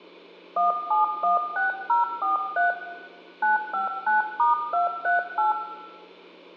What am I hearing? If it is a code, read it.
DTMF, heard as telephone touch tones, dialled by hand, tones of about 140 ms, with room echo. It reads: 1716043 959*238